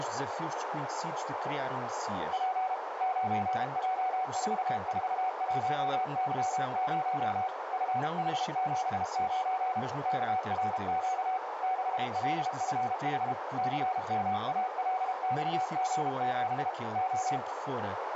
Morse code, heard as a keyed tone, machine-sent, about 32 wpm, 750 Hz, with radio static and a narrow filter. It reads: P 9J441Y0 FH79 KRQ 6LFH CMALXG7 O